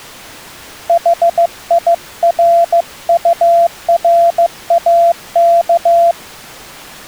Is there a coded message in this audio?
Yes: Morse code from 0.8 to 6.2 s, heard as a keyed tone, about 15 wpm, 680 Hz. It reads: HIRURAK